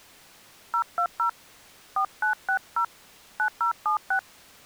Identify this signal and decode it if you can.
DTMF, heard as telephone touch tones, dialled by hand, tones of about 90 ms. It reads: 020 4960 9076